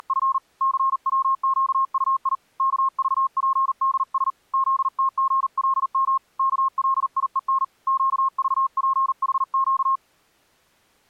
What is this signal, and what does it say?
Morse code, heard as a keyed tone, hand-sent with a paddle, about 40 wpm, 1070 Hz. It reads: … CWQUI KVPDS ZTGLM KLIEN QVPHQ